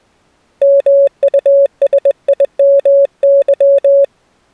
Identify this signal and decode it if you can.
Morse code, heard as a keyed tone, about 21 wpm, 560 Hz. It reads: MUSIMY